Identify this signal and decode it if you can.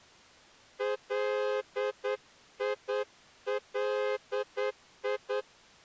Morse code (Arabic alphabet), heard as a horn, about 9 wpm. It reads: ليلي